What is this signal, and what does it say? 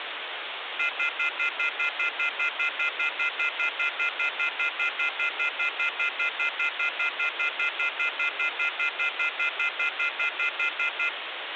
Telephone call progress tone (North American plan), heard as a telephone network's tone, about 1400, 2050, 2450, 2600 Hz, 0.1 s on and 0.1 s off, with phone line noise. Off-hook warning tone.